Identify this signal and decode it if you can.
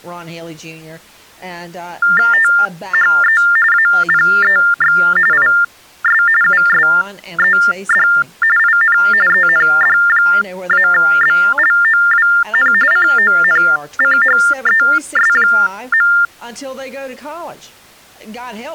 TTY/TDD text telephone tones (45.45 baud Baudot), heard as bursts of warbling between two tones, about 400 Hz shift, 1600 Hz centre, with speech in English. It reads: THE APEX IS USED IN END-BLOWN CONCHES.